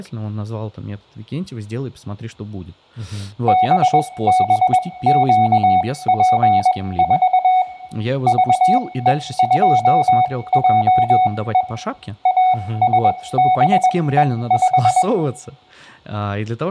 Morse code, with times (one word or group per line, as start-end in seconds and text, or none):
3.5-7.6 BBQP4
8.3-11.6 VE2JE
12.3-15.0 ASBE5